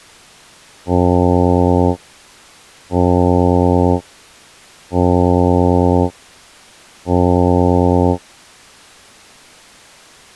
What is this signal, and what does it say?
Ship horn signal, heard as a ship's horn, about 90 Hz. 4 short. At sea: a pilot vessel's identity signal in fog.